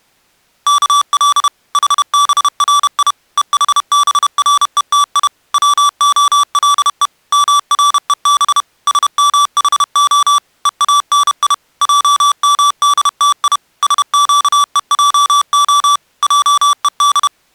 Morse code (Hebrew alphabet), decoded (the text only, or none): כל חברי וחברותי צהלו מרוב שמחה ואני עמדתי שקועה עוד